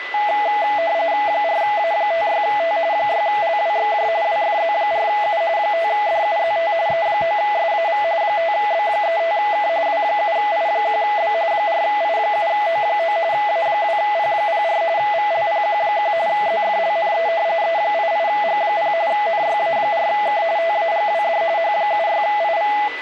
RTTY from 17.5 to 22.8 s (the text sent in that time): E88G0 NYA4K TAGWD H76IV